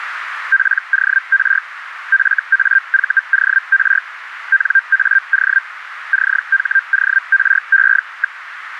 Hellschreiber (Feld-Hell, 122.5 baud), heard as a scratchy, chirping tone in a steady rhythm, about 1600 Hz, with radio static. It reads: POR FAVOR NAO CHORE.